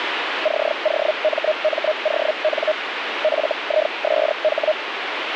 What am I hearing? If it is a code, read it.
Hellschreiber (Feld-Hell, 122.5 baud), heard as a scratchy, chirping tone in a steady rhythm, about 620 Hz, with radio static. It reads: COMMON FISH